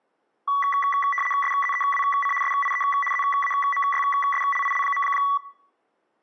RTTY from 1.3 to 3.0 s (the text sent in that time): SZEWC SIE